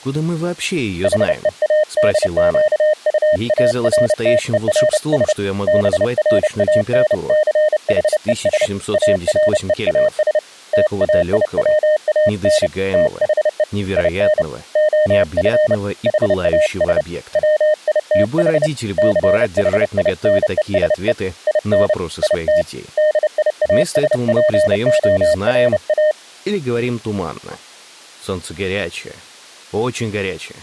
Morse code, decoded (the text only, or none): HEADQUARTERS BRANCHES AREAS TAIWAN THE IN OF HAS WITH CHINESE IN IT DIASPORA